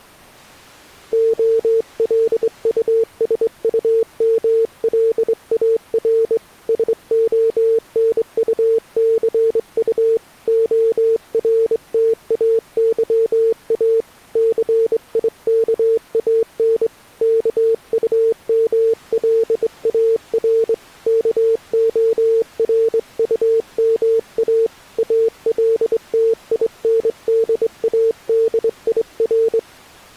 Morse code, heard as a keyed tone, hand-sent with a straight key, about 23 wpm, 450 Hz. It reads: OLUSUMLAR SONUCU ORTAYA CIKAN KUMLAR KORUMA ALTINDADIR